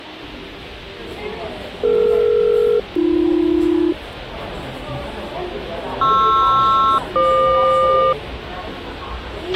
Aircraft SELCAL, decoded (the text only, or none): DE-AB PR-FQ